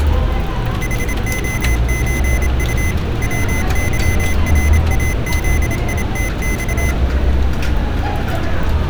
Morse code (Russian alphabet), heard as a high beeper, machine-sent, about 27 wpm, 2050 Hz, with street noise. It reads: ХОЧУ ВЫРАЗИТЬ